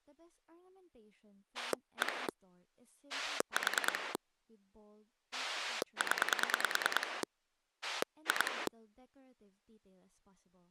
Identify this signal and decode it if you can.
Pulse dialling, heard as a rotary dial, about 9 pulses a second, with speech in English. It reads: 1 4 0 2